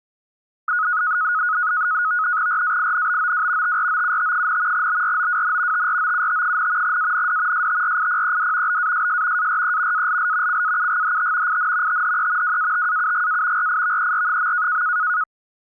NAVTEX (SITOR-B), 100 baud, 170 Hz shift, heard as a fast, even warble, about 1360 Hz centre. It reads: RAINBOW TROUT, BROWN TROUT, AND STRIPED BASS ARE ALL CAUGHT IN THE WATAUGA RIVER.